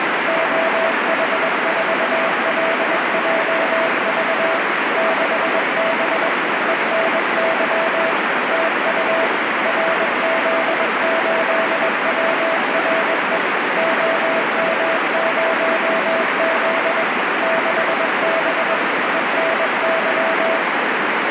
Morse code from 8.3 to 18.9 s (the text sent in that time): TU RZ8WRE OM0Z 6B